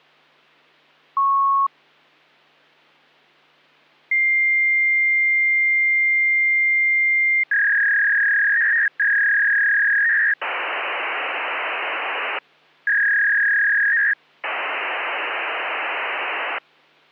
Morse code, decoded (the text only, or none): none